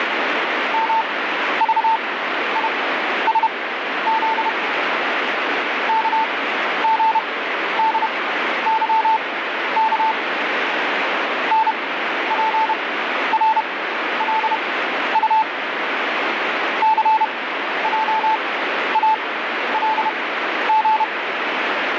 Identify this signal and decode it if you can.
Morse code, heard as a keyed tone, machine-sent, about 31 wpm, spaced as for 12 wpm, 880 Hz, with radio static. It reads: MVISZ KGDYK NPRLU CJALG